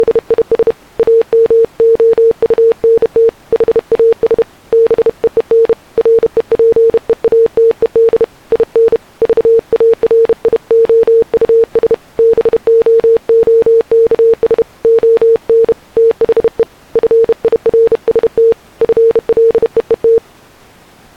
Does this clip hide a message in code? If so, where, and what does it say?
Yes: Morse code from 0.0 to 20.2 s, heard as a keyed tone, hand-sent with a bug key, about 31 wpm, 460 Hz. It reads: … AMOUNT HAS BEEN REPEATED IN VARIOUS BOOKS ON THE FIRST FLEET